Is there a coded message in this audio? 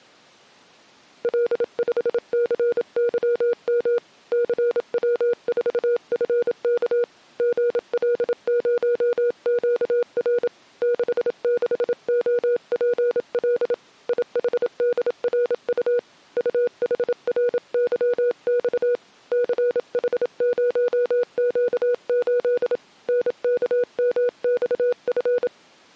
Yes: Morse code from 1.2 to 25.5 s, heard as a keyed tone, hand-sent with a paddle, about 27 wpm, 480 Hz. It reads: L5CYM CW4FK GL0QR 66OPL IHDRU UHRYX CH0Q8 NKMXF